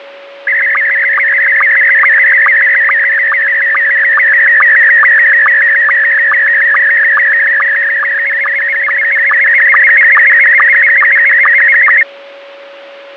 SSTV (slow-scan television), Scottie S1, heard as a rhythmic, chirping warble, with a steady whistle near 560 Hz.